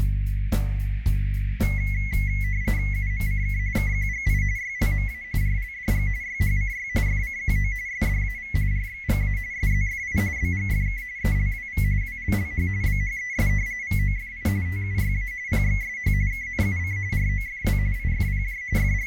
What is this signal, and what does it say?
RTTY (45.45 baud, 170 Hz shift), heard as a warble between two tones, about 2050 Hz centre, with radio static and a narrow filter. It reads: UMCK KQGI YLMA RLDG YHCY FCQO SDAV RXGA SZFI BGFK ELWV WLLH BHES VOFI TUYA PXSH KNUC ROFW IFPJ …